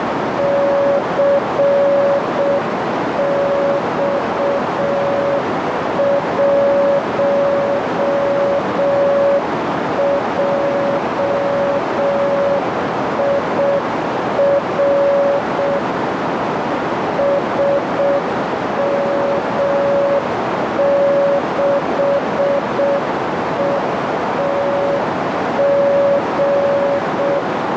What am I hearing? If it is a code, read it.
Morse code, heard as a keyed tone, machine-sent, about 6 wpm, 560 Hz, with heavy radio static and a narrow filter. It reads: CX1JIR SM6ETG